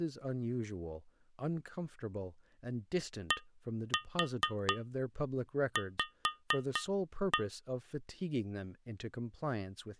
Tap code, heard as taps on glass, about 4 knocks a second, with speech in English. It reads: DV